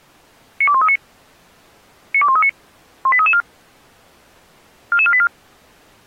Five-tone selective call (ZVEI), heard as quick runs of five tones, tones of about 70 ms. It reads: 92139 92139 18334 44484